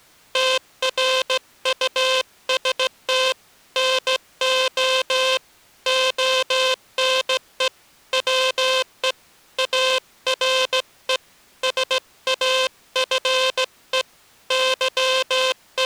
Morse code, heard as a buzzer, hand-sent with a straight key, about 16 wpm. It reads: TRUST NO ONE WE ARE SAFE …